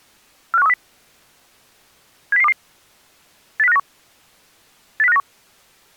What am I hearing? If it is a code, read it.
Five-tone selective call (EEA), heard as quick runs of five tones, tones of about 40 ms. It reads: 45130 70022 80591 80591